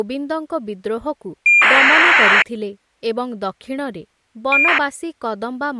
ACARS aircraft data, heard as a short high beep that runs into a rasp, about 2400 baud, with speech in Odia.